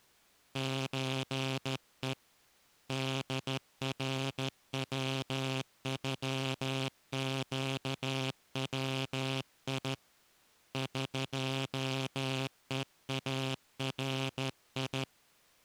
Morse code (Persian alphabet), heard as a buzzer, hand-sent with a straight key, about 13 wpm. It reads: چه دروغگوی قهاری